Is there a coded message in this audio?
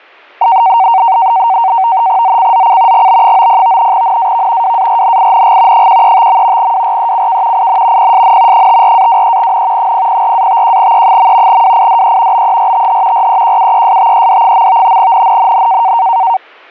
Yes: NAVTEX (SITOR-B), 100 baud, 170 Hz shift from 0.4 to 16.4 s, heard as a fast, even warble, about 840 Hz centre, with static crashes. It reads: ZCZC GB90 NAV WARNING 135. WRECK IN PSN 54-23N 004-51E. WIDE BERTH REQUESTED. NNNN